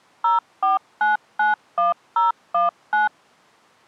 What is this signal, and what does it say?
DTMF, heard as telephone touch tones, dialled by machine, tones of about 150 ms. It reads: 04991019